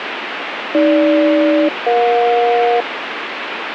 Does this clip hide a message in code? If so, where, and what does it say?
Yes: aircraft SELCAL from 0.7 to 2.8 s, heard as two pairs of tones, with radio static. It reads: AG-EJ